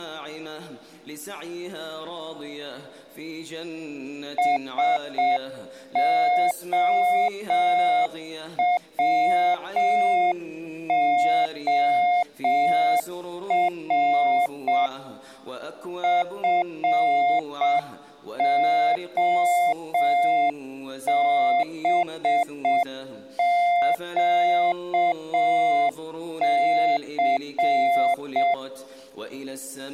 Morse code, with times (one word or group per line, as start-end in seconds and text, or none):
4.4-14.9 SOWOR
16.0-28.5 FOBQC